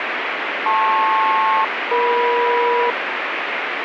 Aircraft SELCAL, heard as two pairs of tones, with radio static. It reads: LP-EM